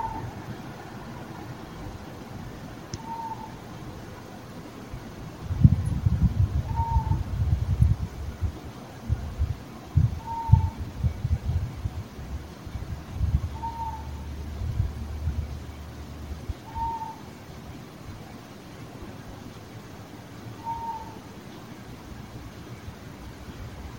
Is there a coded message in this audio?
No.